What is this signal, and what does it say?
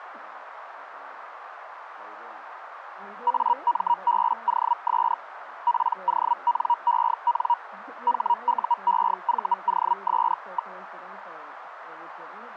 Hellschreiber (Feld-Hell, 122.5 baud), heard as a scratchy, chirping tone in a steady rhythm, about 950 Hz, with radio static. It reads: AMBOS PONEN HUEVOS.